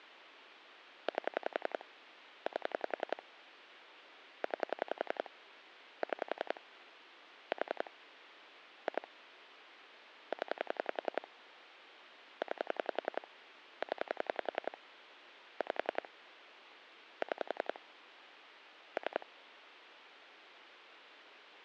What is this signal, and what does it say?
Pulse dialling, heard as clicks on a phone line, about 11 pulses a second. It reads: 8 8 9 6 4 2 0 9 0 5 6 3